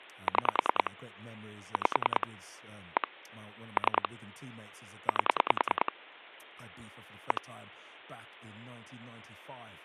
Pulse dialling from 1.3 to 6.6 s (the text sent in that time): 5 1 3 8